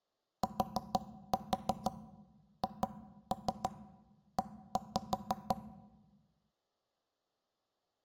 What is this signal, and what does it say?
Tap code, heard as knocks on wood, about 6 knocks a second. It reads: THE